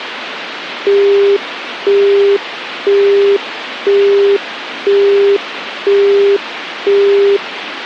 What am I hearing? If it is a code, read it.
Telephone call progress tone (single-tone plan, as in Europe, Japan and elsewhere), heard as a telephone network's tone, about 400 Hz, 0.5 s on and 0.5 s off, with phone line noise. Busy tone.